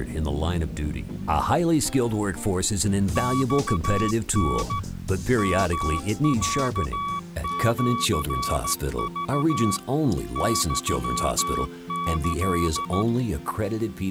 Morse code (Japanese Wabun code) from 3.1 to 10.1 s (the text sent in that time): マタ ヨロシク